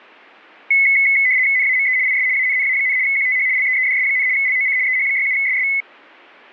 RTTY (75 baud, 170 Hz shift), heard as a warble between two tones, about 2100 Hz centre. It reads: NAME IS ANNA, QTH LEEDS, LOC EH67SS